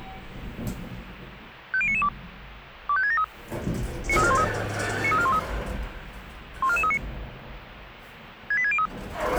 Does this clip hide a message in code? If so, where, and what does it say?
Yes: five-tone selective call (ZVEI) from 1.7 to 8.9 s, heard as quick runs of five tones, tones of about 70 ms, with the noise inside a lift. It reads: 50992 25673 93413 93413 14439 68603